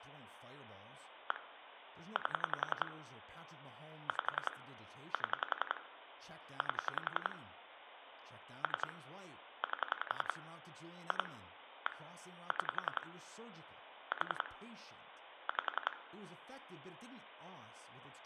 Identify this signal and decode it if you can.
Pulse dialling, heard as clicks on a phone line, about 11 pulses a second, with phone line noise, room echo and speech in English. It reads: 1 8 5 7 8 3 8 2 1 6 4 5